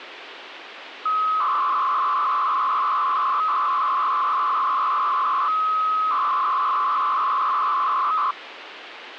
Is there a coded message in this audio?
Yes: 300-baud modem data (Bell 103 tones) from 1.1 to 8.3 s, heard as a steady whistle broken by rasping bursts, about 300 baud, 200 Hz shift, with phone line noise.